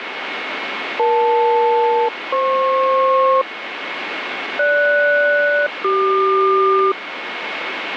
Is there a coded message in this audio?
Yes: aircraft SELCAL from 1.0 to 6.9 s, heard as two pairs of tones, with radio static. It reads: EL-FP GS-CQ